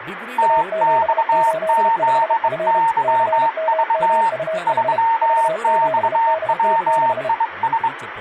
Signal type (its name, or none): Morse code